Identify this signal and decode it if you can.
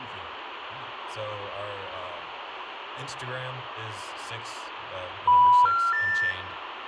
Telephone call progress tone (North American plan), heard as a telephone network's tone, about 980, 1370, 1800 Hz, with phone line noise and speech in English. Special information tone.